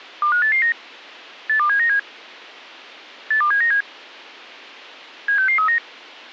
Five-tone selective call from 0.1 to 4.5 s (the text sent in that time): 25889 82797 82797